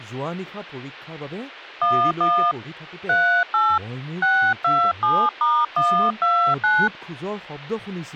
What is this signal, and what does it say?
DTMF, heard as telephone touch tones, dialled by hand, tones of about 300 ms, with speech in Assamese. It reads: 11 38 627*129